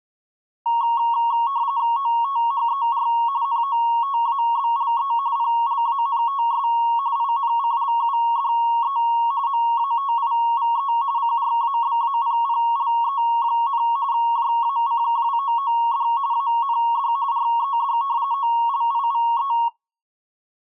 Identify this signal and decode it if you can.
RTTY (45.45 baud, 170 Hz shift), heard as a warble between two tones, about 1020 Hz centre. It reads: OTHER NOTABLE PLANTS INCLUDE MATIVE CRABAPPLE, JACKWOOD AND RED OLIVE